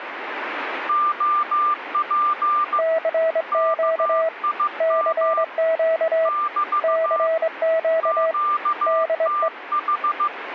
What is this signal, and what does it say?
Morse code, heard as two keyed tones, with radio static. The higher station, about 15 wpm, 1190 Hz: OP KIM <BT> QTH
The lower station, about 21 wpm, 650 Hz: CQ CQ CQ DE